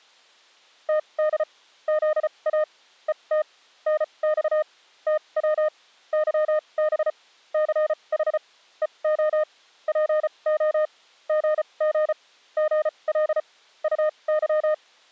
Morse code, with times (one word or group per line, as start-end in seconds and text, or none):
0.9-1.4 TD
1.9-2.6 ZA
3.1-3.4 ET
3.9-4.6 NX
5.1-5.7 TW
6.1-7.1 YB
7.5-8.4 CH
8.8-9.4 EO
9.9-10.9 PO
11.3-12.1 GG
12.6-13.4 GL
13.8-14.7 UY